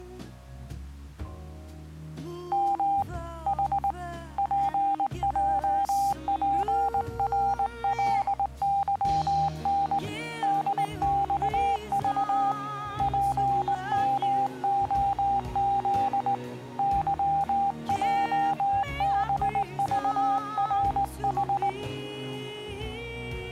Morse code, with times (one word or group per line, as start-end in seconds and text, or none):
2.5-3.0 M
3.5-3.9 H
4.4-10.0 PJPRLYN
10.4-12.5 DXV
13.0-16.3 PMOZ
16.8-21.7 YJBVRH